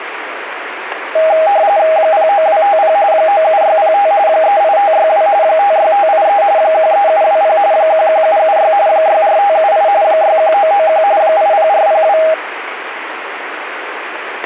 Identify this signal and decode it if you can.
RTTY (45.45 baud, 170 Hz shift), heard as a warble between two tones, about 720 Hz centre, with radio static. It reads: 09250 97605 38562 56583 13720 11776 64578 61991 80402